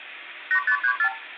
Multi-frequency trunk signalling (R2, with the far end's replies), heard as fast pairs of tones, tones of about 80 ms, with phone line noise and room echo. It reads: 8534